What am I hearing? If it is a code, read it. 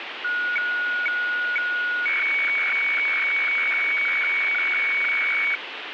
Weather fax (radiofax), 120 lines a minute, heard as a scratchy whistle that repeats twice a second, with radio static.